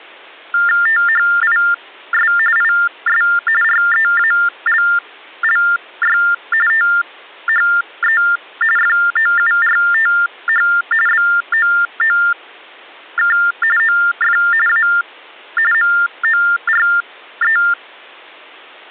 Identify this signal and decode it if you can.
TTY/TDD text telephone tones (45.45 baud Baudot), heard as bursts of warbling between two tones, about 400 Hz shift, 1600 Hz centre. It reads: THIS IS REALLY THE FOURTH BOOK OF A MORE